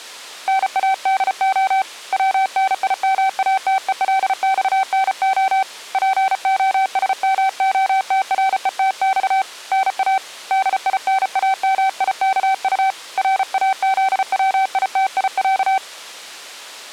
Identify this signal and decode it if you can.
Morse code (Russian alphabet), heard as a keyed tone, hand-sent with a paddle, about 34 wpm, 770 Hz. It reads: НАДО ВНИМАТЕЛЬНО ПОСМОТРЕТЬ НА ДИНАМИКУ РАЗВИТИЯ